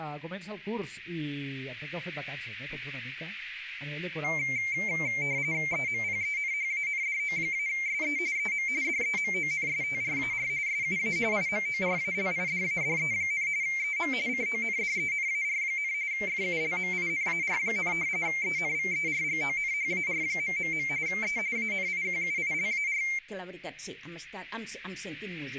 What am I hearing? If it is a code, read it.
RTTY (45.45 baud, 170 Hz shift), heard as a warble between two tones, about 2200 Hz centre, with radio static. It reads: EMPENHANDO-SE EM DEMONSTRAR SUA IMORALIDADE, EM CONDENAR, FULMINAR, ENVERGONHAR... E ANIQUILAR